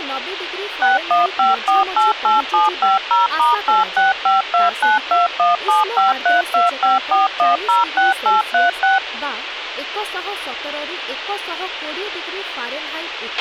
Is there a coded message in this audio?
Yes: DTMF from 0.8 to 9.0 s, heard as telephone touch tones, dialled by machine, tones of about 160 ms, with radio hiss, a squelch burst at the end and speech in Odia. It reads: 615488750*8652921753254106836